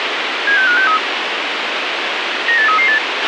Five-tone selective call (CCIR), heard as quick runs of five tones, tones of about 100 ms, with radio hiss and a squelch burst at the end. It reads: 76563 98338